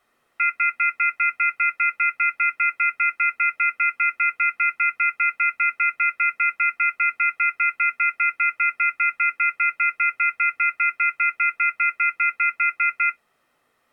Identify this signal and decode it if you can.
Telephone call progress tone (North American plan), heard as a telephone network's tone, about 1400, 2050, 2450, 2600 Hz, 0.1 s on and 0.1 s off. Off-hook warning tone.